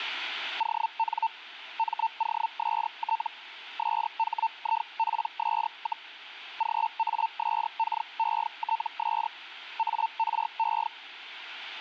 Hellschreiber (Feld-Hell, 122.5 baud), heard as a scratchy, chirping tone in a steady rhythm, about 900 Hz. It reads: ON MOST SHIPS, GASKETS ARE